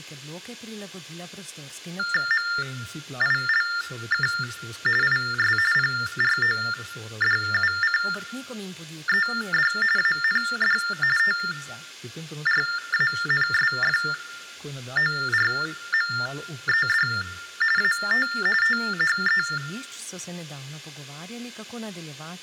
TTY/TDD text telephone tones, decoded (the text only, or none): MILK IS PRODUCED AND TRANSFORMED AT THE